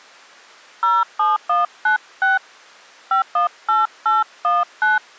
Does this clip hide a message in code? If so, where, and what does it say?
Yes: DTMF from 0.8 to 5.0 s, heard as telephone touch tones, dialled by hand, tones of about 150 ms. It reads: 07196 518819